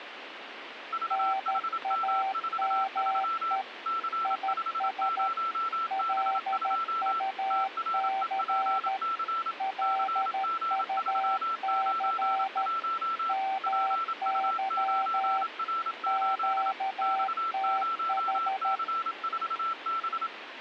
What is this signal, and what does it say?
Morse code, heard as two keyed tones, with radio static. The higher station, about 27 wpm, 1340 Hz: VHM43 C50B2 TREPC CG391 PU9R8 X0C4B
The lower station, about 13 wpm, 770 Hz: NAME IS LUC LUC MY QTH